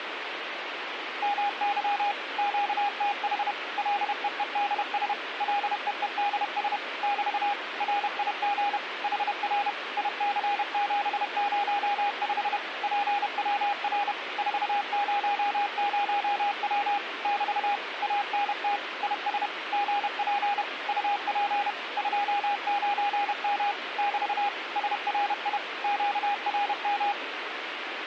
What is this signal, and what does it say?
Morse code, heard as a keyed tone, machine-sent, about 31 wpm, 810 Hz, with radio static. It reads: MY QTH LEEDS LEEDS <BT> RIG HR IC705 PWR 400W <BT> ANT IS GP UP 29M <BT> SRI QRM